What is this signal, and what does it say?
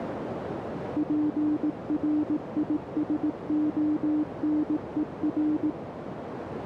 Morse code, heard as a keyed tone, machine-sent, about 18 wpm, 300 Hz, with radio static and a narrow filter. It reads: PRISONER